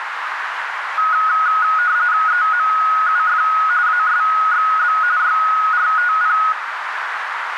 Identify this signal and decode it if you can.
RTTY (45.45 baud, 170 Hz shift), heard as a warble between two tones, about 1360 Hz centre, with radio static and a narrow filter. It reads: EMUF ASXB YRTP